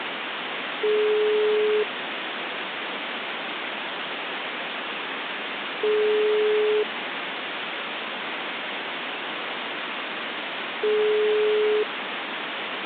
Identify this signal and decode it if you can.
Telephone call progress tone (single-tone plan, as in most of Europe), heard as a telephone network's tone, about 420 Hz, 1 s on and 4 s off, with phone line noise. Ringback tone.